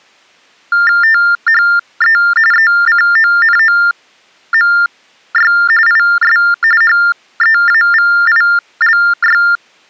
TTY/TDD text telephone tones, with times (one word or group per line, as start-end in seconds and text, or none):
1.0-2.2 THE
2.5-5.5 ECONOMY
5.9-6.4 IS
6.8-9.4 HEAVILY